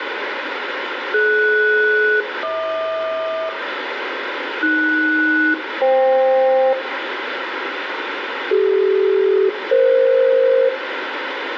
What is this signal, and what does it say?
Aircraft SELCAL, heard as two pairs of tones, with radio static and room echo. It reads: DS-HQ AS-FK CD-EF